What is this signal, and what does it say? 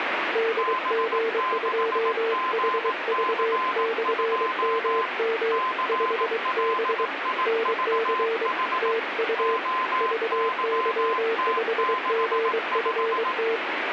Morse code, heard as two keyed tones, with radio static. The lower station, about 23 wpm, 450 Hz: DG2HV/MM 5B NC TU VY5GFT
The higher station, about 18 wpm, 1030 Hz: B6GC2 CLIVH OYT65